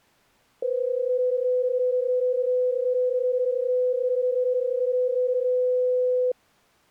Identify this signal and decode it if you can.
PSK31 (31.25 baud), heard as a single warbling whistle, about 500 Hz.